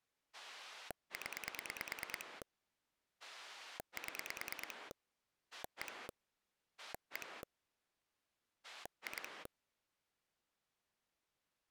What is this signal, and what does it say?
Pulse dialling, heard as a rotary dial, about 9 pulses a second. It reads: 0 7 1 1 2